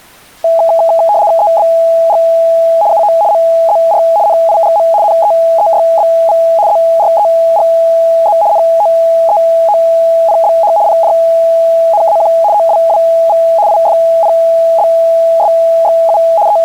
RTTY (75 baud, 170 Hz shift), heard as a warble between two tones, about 750 Hz centre. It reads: EBG UO MZR NIGM NEEYBV ZREGZ NOEOPBH PJNAQ OWWV IFPBSXU …